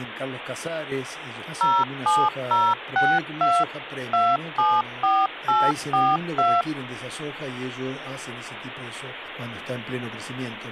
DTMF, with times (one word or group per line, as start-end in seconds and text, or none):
1.6-3.6 07062
4.1-6.6 274842